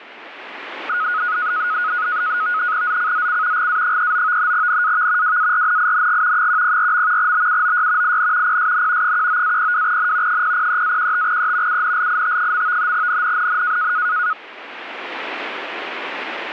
NAVTEX (SITOR-B), 100 baud, 170 Hz shift, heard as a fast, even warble, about 1360 Hz centre, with radio static. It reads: ZCZC GA39 NAV WARNING 104. BUOY IN PSN 19-02N 003-15E UNLIT. NNNN